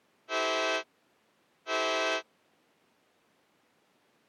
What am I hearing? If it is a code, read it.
Train horn signal, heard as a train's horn. 2 short. On North American railways: a signal is acknowledged.